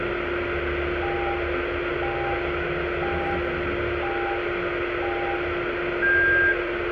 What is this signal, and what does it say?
Radio time signal (five pips and a higher one, as on Chinese radio), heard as pips, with radio static, a steady whistle near 350 Hz, room echo and the noise inside a car.